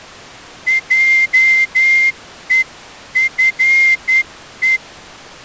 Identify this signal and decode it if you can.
Morse code (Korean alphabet), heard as a whistle, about 10 wpm. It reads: 하나